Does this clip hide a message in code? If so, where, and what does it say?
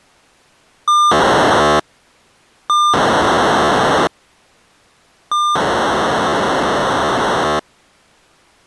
Yes: POCSAG pager data (2400 baud) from 0.9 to 7.6 s, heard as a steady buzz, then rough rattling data.